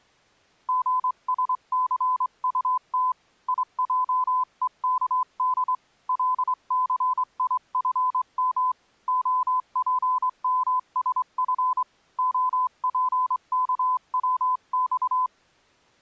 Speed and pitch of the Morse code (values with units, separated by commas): 24 wpm, 1010 Hz